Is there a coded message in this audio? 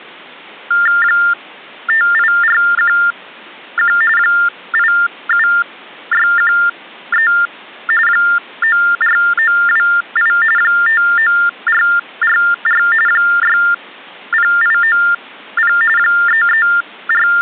Yes: TTY/TDD text telephone tones (45.45 baud Baudot) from 0.7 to 17.4 s, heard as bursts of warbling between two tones, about 400 Hz shift, 1600 Hz centre. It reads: 58411 87613 94928 59444 60890 …